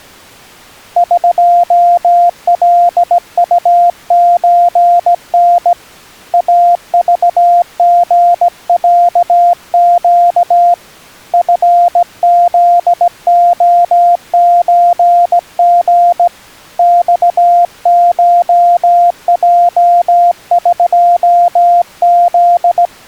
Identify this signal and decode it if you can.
Morse code (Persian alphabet), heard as a keyed tone, hand-sent with a straight key, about 17 wpm, 700 Hz. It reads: قلطچن اذژصگ فزعچژ خشجقز